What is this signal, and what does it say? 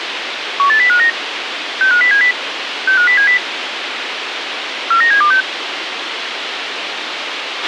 Five-tone selective call (CCIR), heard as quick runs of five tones, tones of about 100 ms, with radio hiss and a squelch burst at the end. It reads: 18059 65070 65070 49726